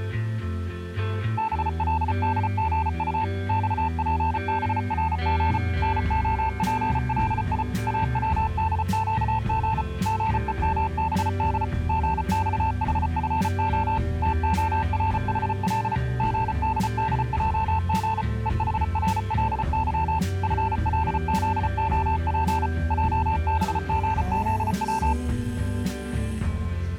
Morse code, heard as a keyed tone, machine-sent, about 34 wpm, 880 Hz. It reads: BLDGU XPBRG NOPLI AWDQG GEMBD GXHFO TORHL GDDJG EHRLY FLZOP JBGZW